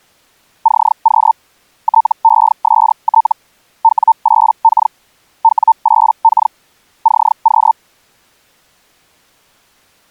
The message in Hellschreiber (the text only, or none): CQ TEST W8K W8K CQ